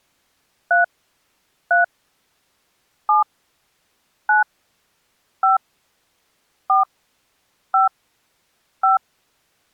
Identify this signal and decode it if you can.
DTMF, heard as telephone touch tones, dialled by hand, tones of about 140 ms. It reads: 3 3 7 9 5 4 5 5